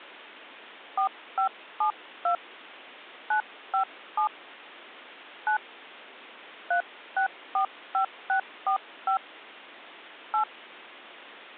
DTMF, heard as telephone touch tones, dialled by hand, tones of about 100 ms. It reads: 4572 957 9 3645645 8